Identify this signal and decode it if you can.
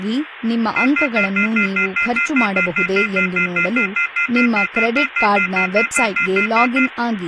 Telephone call progress tone (North American plan), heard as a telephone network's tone, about 1400, 2050, 2450, 2600 Hz, 0.1 s on and 0.1 s off, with phone line noise and speech in Kannada. Off-hook warning tone.